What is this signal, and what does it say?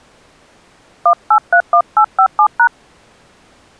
DTMF, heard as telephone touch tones, dialled by hand, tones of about 80 ms. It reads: 1831857#